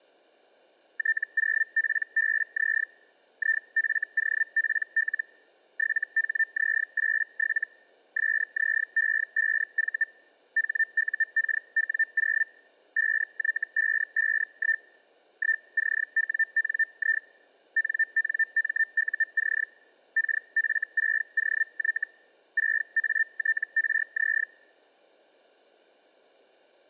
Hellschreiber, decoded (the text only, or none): T0PBZ IFOPL 7HZ87 SZE5V HUKW0 5Y551 1CWNI NNMUC KF6OY 6ATRZ